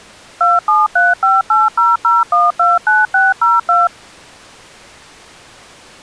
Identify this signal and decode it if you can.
DTMF, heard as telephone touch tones, dialled by machine, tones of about 180 ms. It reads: 2735800129602